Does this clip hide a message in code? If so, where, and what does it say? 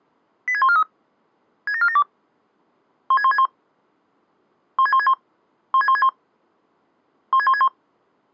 Yes: five-tone selective call (ZVEI) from 0.5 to 7.7 s, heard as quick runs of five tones, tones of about 70 ms. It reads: 86143 67472 16161 16161 16161 16161